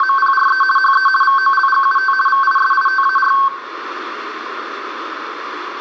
RTTY (50 baud, 450 Hz shift), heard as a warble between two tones, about 1320 Hz centre, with radio static and room echo. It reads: … HE VOLGUT VISITAR